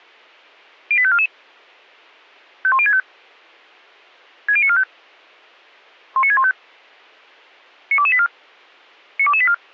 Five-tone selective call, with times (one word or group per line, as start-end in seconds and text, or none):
0.9-1.3 08544
2.6-3.0 51065
4.5-4.8 60945
6.2-6.5 19615
7.9-8.3 92284
9.2-9.5 92284